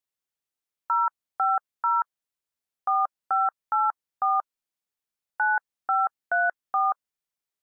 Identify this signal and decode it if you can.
DTMF, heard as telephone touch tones, dialled by hand, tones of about 180 ms. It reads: 050 4584 9534